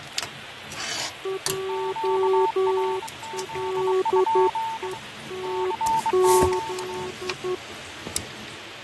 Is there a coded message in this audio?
Yes: Morse code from 1.2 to 7.6 s, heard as two keyed tones, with radio static, fading and kitchen noise. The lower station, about 11 wpm, 380 Hz: JLETZ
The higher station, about 23 wpm, 900 Hz: QRZ? CQ